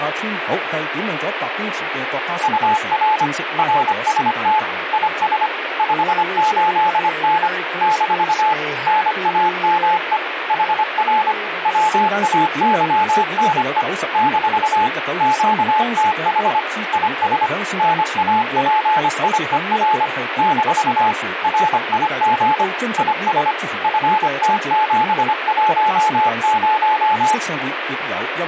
Morse code, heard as a keyed tone, machine-sent, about 25 wpm, 860 Hz, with radio static. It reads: UR RST IS 58N - NAME HR WAYNE - QTH IS NAPIER - RIG IS FT710